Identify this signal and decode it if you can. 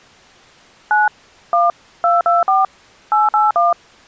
DTMF, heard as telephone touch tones, dialled by machine, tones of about 170 ms. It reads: 9 1 224 881